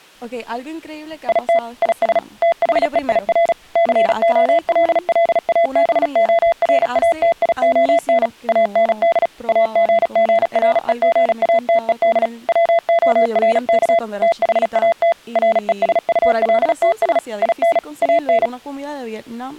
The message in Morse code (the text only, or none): IT IS THEIR COLLABORATION AND AGGREGATED WORK THAT RESULTS IN AN